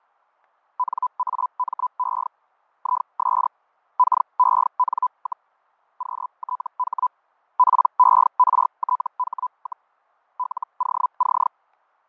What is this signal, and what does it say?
Hellschreiber (Feld-Hell, 122.5 baud), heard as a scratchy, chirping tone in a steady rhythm, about 1000 Hz, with fading. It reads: NAME IS KEN, QTH PERTH, LOC